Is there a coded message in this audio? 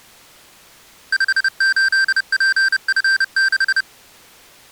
Yes: Morse code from 1.1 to 3.9 s, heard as electronic beeps, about 30 wpm, 1550 Hz. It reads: 58PF6